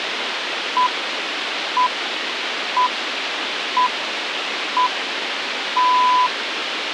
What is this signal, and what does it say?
Radio time signal (six pips, as the Greenwich Time Signal), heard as pips, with radio hiss.